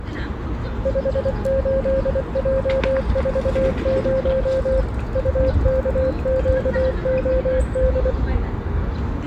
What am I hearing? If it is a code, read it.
Morse code, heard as a keyed tone, machine-sent, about 24 wpm, 530 Hz, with the noise of a park. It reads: 58J40 UKQOD